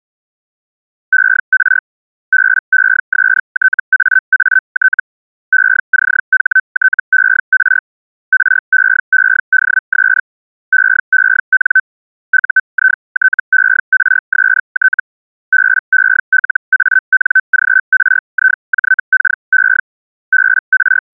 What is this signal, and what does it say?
Hellschreiber (Feld-Hell, 122.5 baud), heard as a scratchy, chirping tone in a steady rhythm, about 1550 Hz. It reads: ER BESTAAT ECHTER REEDS EEN UITERST BELANGRIJKE …